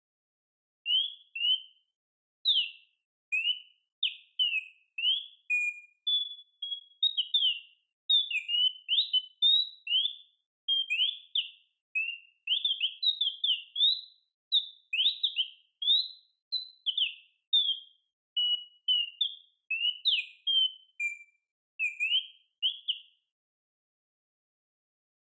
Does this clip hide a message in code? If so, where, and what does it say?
No, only bird-like chirps, with room echo.